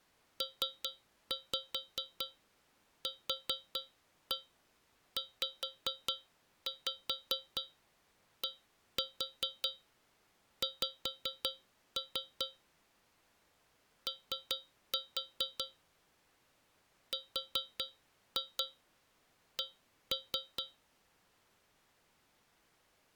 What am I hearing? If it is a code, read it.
Tap code, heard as taps on a metal pipe, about 4 knocks a second. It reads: PQZDX O RC